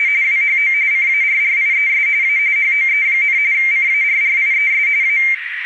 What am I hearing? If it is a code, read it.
RTTY (45.45 baud, 170 Hz shift), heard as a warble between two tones, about 2200 Hz centre, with radio static and a narrow filter. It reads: … WHO CARRIES A HOE, CARRIES A